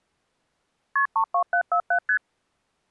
Multi-frequency trunk signalling (R1, as on North American trunks), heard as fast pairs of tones, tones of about 80 ms. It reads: KP 32747 ST